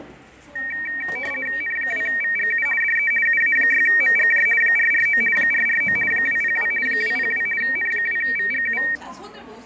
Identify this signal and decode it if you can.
RTTY (50 baud, 450 Hz shift), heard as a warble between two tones, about 2100 Hz centre, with fading and the noise of a cafe. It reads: N2VGU DE UA6MGJ 449 449 202 202 N2VGU